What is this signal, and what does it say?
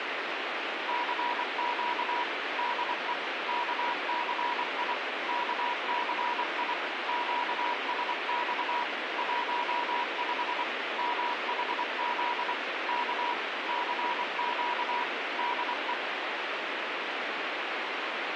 Morse code, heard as a keyed tone, machine-sent, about 24 wpm, 970 Hz, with radio hiss and a squelch burst at the end. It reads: CQ DE KCI KCI QSX 15 MHZ K CQ DE